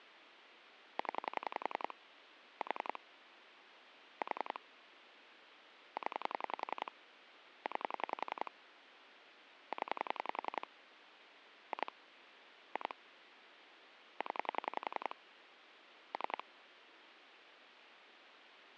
Pulse dialling, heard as clicks on a phone line, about 11 pulses a second, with phone line noise. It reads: 0 4 4 0 9 0 2 2 0 3